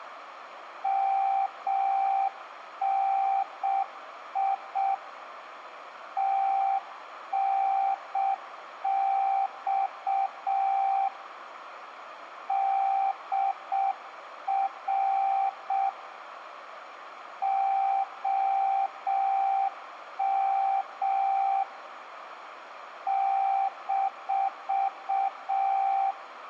Morse code, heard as a keyed tone, hand-sent with a paddle, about 6 wpm, 780 Hz, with radio static and room echo. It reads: MNI TNX DR OM -